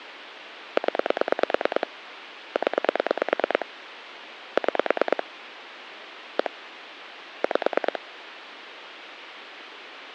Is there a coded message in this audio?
Yes: pulse dialling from 0.8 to 8.0 s, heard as clicks on a phone line, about 9 pulses a second, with phone line noise. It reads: 0 0 6 1 5